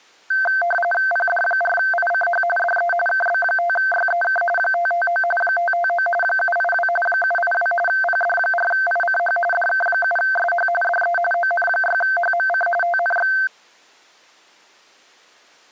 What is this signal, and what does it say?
RTTY (45.45 baud, 850 Hz shift), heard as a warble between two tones, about 1120 Hz centre. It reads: PD4ICH DE KB5YEK 559 559 782 782 PD4ICH DK7SH DE ON6HMC TNX